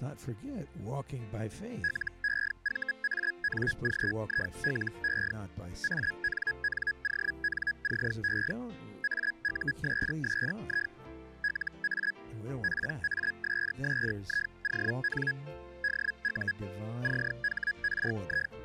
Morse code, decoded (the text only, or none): none